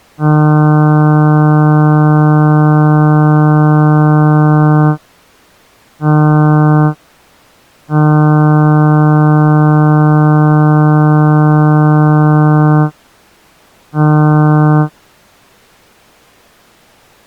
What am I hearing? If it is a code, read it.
Ship horn signal, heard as a ship's horn, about 150 Hz. 1 long, 1 short, 1 long, 1 short. At sea: I agree to be overtaken.